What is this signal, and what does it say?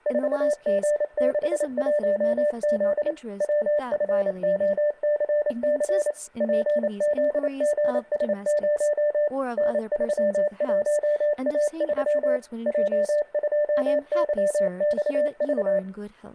Morse code, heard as a keyed tone, machine-sent, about 28 wpm, 590 Hz, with room echo and speech in English. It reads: 4G61Z WFOCC PZGS0 N31A3 J2YXV